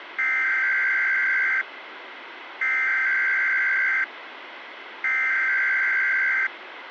Emergency Alert System (SAME) tones (header bursts), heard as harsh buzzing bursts, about 520.83 baud, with radio hiss.